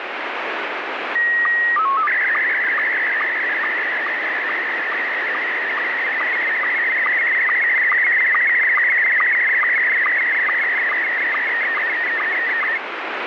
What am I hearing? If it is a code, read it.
SSTV (slow-scan television), Scottie S1, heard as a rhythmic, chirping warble, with heavy radio static.